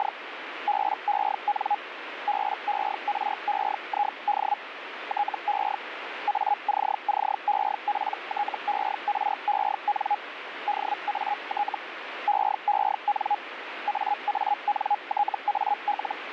Hellschreiber (Feld-Hell, 122.5 baud), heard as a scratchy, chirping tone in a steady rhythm, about 830 Hz, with radio static. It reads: … BEN BEREID TE ACCEPTEREN DAT EEN AANTAL